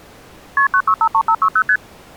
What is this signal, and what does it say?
Multi-frequency trunk signalling (R1, as on North American trunks), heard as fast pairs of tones, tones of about 70 ms. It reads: KP 9653560 ST